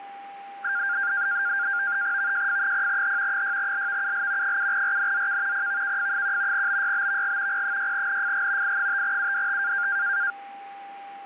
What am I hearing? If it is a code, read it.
NAVTEX (SITOR-B), 100 baud, 170 Hz shift, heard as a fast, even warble, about 1500 Hz centre, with a steady whistle near 800 Hz. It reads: VJF0H 6LVUL 7RNZK PVKF1 BYBVG P6NFG I5UDT